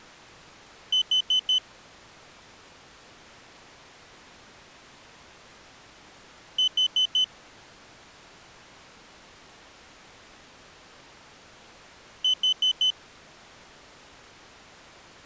Alarm pattern, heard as an alarm's beeps, played three times, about 3050 Hz. Temporal four. Carbon monoxide.